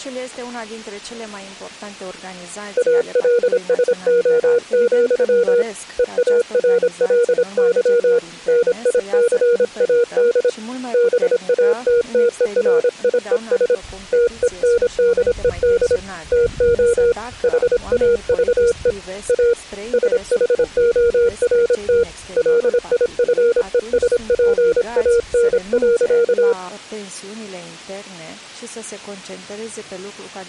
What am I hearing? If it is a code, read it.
Morse code, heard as a keyed tone, hand-sent with a paddle, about 26 wpm, 470 Hz. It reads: ALSO, EARLY NICAD BATTERIES TENDED TO HAVE A SHORT LIFESPAN.